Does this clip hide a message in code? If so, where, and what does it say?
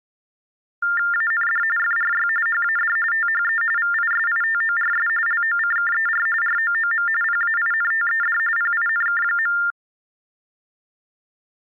Yes: TTY/TDD text telephone tones (45.45 baud Baudot) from 0.8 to 9.7 s, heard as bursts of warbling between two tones, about 400 Hz shift, 1600 Hz centre. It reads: AND FRY HAD THE VISITORS LOCKER ROOM PAINTED PINK.